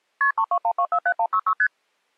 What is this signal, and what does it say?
Multi-frequency trunk signalling (R1, as on North American trunks), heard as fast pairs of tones, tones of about 70 ms. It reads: KP 321247166 ST